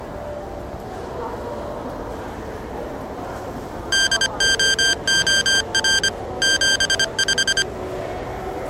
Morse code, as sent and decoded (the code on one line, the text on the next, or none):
-.. --- --- .-. / --... .....
DOOR 75